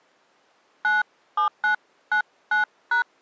DTMF, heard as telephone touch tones, dialled by hand, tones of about 120 ms. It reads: 97999#